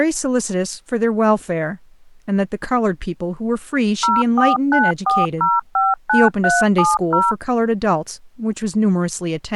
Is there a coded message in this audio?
Yes: DTMF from 4.0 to 7.3 s, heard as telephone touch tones, dialled by machine, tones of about 190 ms, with speech in English. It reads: 0494059370